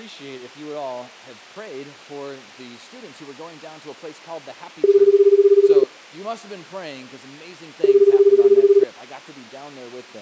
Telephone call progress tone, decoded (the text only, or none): ringback tone